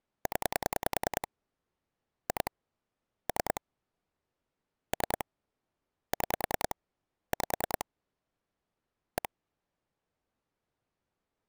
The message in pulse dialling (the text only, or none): 0 2 3 3 6 5 1